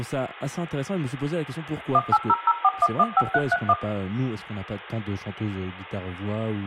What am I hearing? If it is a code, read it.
DTMF, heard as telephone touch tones, dialled by machine, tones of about 50 ms, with room echo and speech in French. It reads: 18004115331